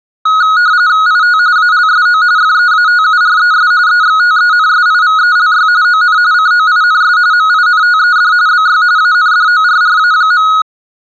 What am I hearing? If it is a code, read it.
RTTY (45.45 baud, 170 Hz shift), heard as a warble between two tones, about 1360 Hz centre. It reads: IT ALSO FEATURES EXTENSIVELY ON COINS MINTED BY ANDORRA.